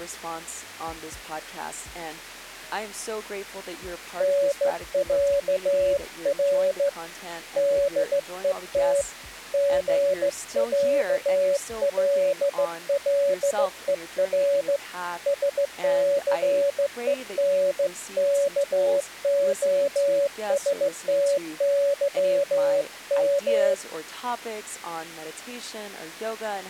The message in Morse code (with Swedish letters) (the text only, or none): NÄR DET GÄLLER SCENKOSTYM